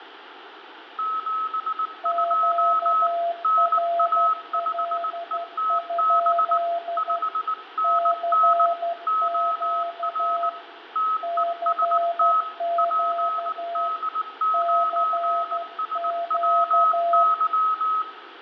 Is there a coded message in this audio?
Yes: Morse code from 0.9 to 18.1 s, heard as two keyed tones, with radio static, fading and room echo. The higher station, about 19 wpm, 1280 Hz: 72 NA5ETB 5NN OR TEST PD9SWY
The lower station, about 12 wpm, 680 Hz: QRL? CQ CQ CQ